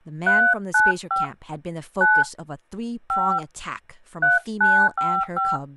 DTMF, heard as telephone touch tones, dialled by hand, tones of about 260 ms, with speech in English. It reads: 395 9 5 3955